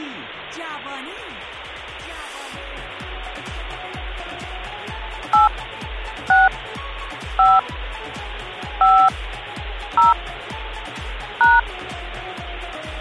DTMF, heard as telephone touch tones, dialled by hand, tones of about 210 ms. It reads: 8 6 5 5 0 #